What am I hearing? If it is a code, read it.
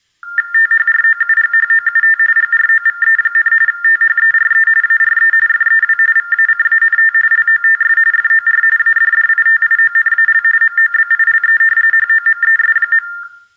TTY/TDD text telephone tones (45.45 baud Baudot), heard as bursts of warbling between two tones, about 400 Hz shift, 1600 Hz centre, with room echo. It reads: THROUGHOUT GROVE, THERE ARE FEW VACANT LOTS FOR ADDITIONAL MOBILE HOMES.